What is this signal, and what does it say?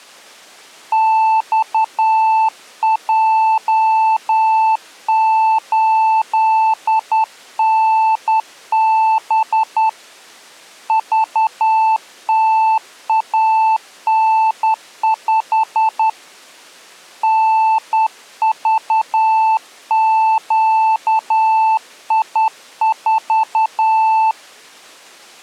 Morse code, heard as a keyed tone, hand-sent with a straight key, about 10 wpm, 880 Hz. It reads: XJ8NB VTAN5 NVQI4